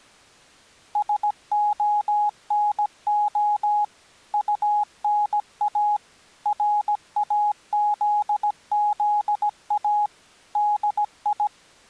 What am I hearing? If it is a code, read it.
Morse code, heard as a keyed tone, machine-sent, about 17 wpm, 830 Hz. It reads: SONO UNA RAZZA DI